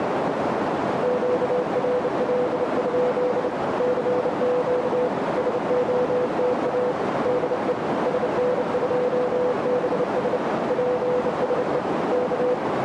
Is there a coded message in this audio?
Yes: Morse code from 1.0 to 12.6 s, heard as a keyed tone, hand-sent with a bug key, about 29 wpm, 500 Hz, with heavy radio static and a narrow filter. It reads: QRL? CQ SOTA DE SN2BS PSE K